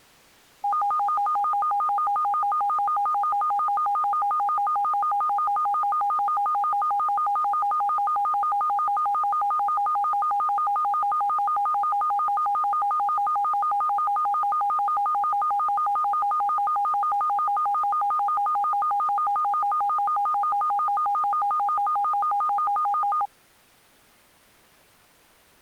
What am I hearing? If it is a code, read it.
A tone that alternates evenly between two pitches. There is no code.